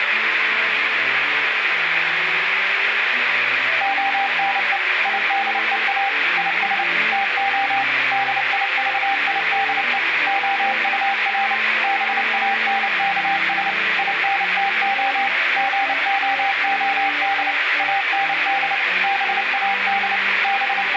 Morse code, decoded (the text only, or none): ONE IDEA IS TO DIVIDE OUR BANKS INTO GOOD AND BAD …